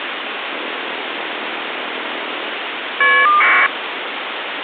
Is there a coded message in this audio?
Yes: caller ID data burst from 0.5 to 3.7 s, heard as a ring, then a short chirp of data, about 1200 baud, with phone line noise.